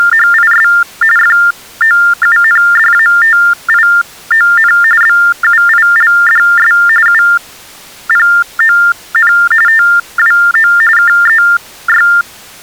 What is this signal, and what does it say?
TTY/TDD text telephone tones (45.45 baud Baudot), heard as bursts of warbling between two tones, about 400 Hz shift, 1600 Hz centre. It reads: … FOUNDATION BUILDS UPON TWO KEY